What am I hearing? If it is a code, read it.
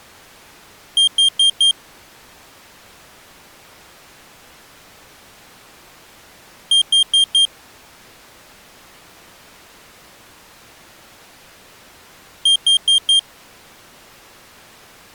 Alarm pattern, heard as an alarm's beeps, played three times, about 3200 Hz. Temporal four. Carbon monoxide.